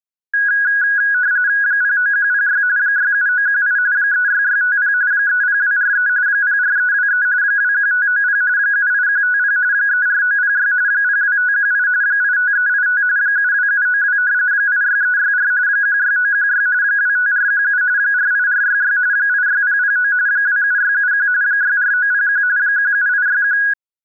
RTTY (45.45 baud, 170 Hz shift), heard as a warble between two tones, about 1550 Hz centre. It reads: 09106 67918 36650 30243 04323 21590 78150 34906 02518 85385 72792 86364 16916 25417 48466 86009 27671 64901 17861